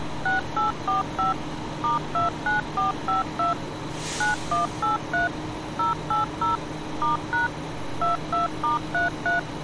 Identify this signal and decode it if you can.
DTMF, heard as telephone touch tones, dialled by machine, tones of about 140 ms, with street noise. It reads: 6845 *29452 9183 080 *# 22*33